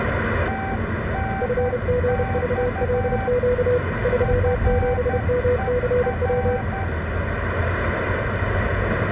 Morse code, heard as two keyed tones, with radio static, room echo and the noise inside a car. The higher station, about 11 wpm, 780 Hz: TNX FER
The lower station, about 31 wpm, 490 Hz: FGVLQ 37MCW